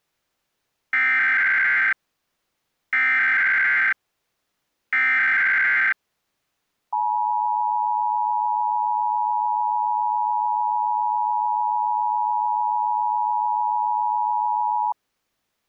Emergency Alert System (SAME) tones (header bursts, then the 853 and 960 Hz attention tone), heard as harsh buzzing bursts, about 520.83 baud.